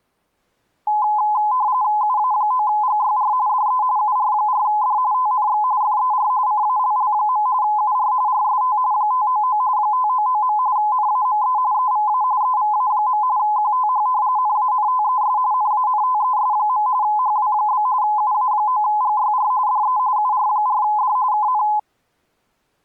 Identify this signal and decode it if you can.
RTTY (45.45 baud, 170 Hz shift), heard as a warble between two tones, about 930 Hz centre. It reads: UA9GYR DE UR4D TNX FER CALL. UR RST 599 599. NAME EVA EVA. QTH NANTES NANTES. HW? UA9GYR DE UR4D KN